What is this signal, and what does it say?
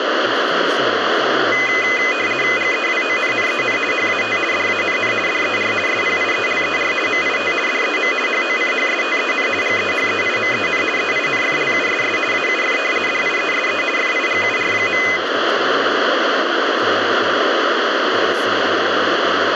RTTY (50 baud, 450 Hz shift), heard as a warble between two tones, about 2250 Hz centre, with radio static and speech in English. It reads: GEWONNEN HAT DANN DER SPIELER MIT DEM HOCHSTEN GEHEIMEN EINFLUSS AUF DIESE FIGUR.